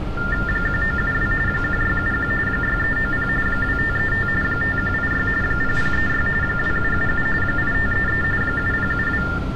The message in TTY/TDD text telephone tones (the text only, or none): 1972 1671 6390 2535 5186 0036 2777 8533 7072